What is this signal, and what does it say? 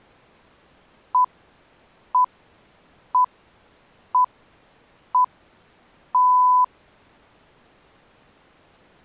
Radio time signal (six pips, as the Greenwich Time Signal), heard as pips.